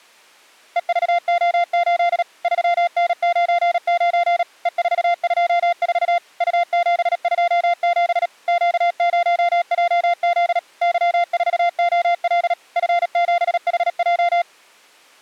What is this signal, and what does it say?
Morse code, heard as a keyed tone, machine-sent, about 37 wpm, 700 Hz. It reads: EVO8 3N99 E424 U727 Q0JZ Y4OL F7HJ